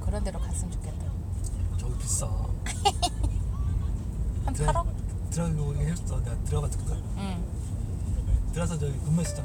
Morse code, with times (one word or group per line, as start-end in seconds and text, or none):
none